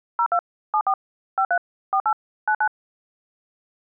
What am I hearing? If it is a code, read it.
DTMF, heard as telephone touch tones, dialled by machine, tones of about 70 ms. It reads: 02 74 53 48 99